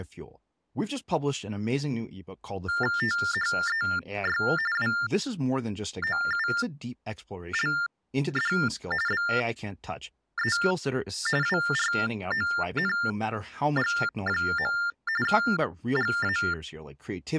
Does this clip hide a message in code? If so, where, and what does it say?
Yes: TTY/TDD text telephone tones (45.45 baud Baudot) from 2.7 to 16.5 s, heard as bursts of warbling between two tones, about 400 Hz shift, 1600 Hz centre, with speech in English. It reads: THEY WOULD BE WRONG. GA